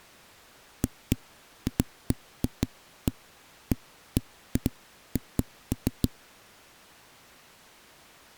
Irregular knocks on a wall. There is no code.